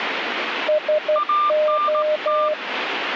Morse code, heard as two keyed tones, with radio static. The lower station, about 12 wpm, 610 Hz: SO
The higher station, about 18 wpm, 1190 Hz: ANT